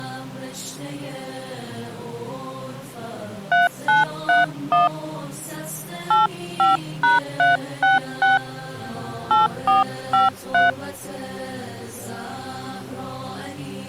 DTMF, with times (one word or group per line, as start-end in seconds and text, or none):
3.5-4.9 3931
6.1-8.4 85#366
9.3-10.7 8453